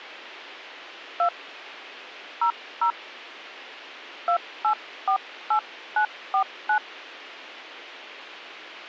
DTMF, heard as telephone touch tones, dialled by hand, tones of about 90 ms. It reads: 2 00 2848949